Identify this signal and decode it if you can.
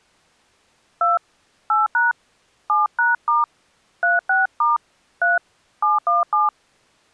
DTMF, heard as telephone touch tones, dialled by hand, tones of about 160 ms. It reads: 2 8# 7#* 36* 3 717